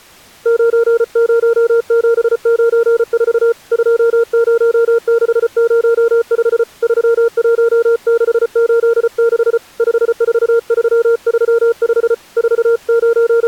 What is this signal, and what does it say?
Morse code, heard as a keyed tone, hand-sent with a paddle, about 34 wpm, 460 Hz. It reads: 90794 20605 31686 54335 …